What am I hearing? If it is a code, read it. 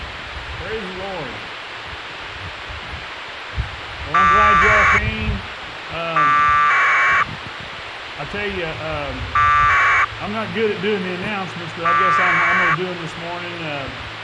Packet radio (AX.25, as in APRS), 1200 baud, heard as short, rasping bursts, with radio hiss.